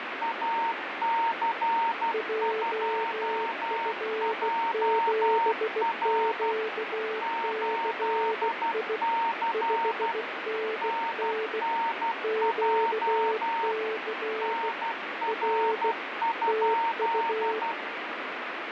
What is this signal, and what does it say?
Morse code, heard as two keyed tones, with heavy radio static. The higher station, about 12 wpm, 920 Hz: AC2JR 8C NNJ NR?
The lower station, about 16 wpm, 440 Hz: JF7QCI 5NN QC R TU